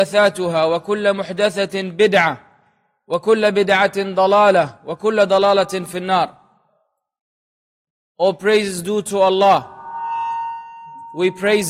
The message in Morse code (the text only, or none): none